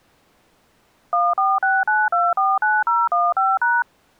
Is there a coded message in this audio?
Yes: DTMF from 1.1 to 3.8 s, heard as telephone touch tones, dialled by machine, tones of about 210 ms. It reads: 1469249015#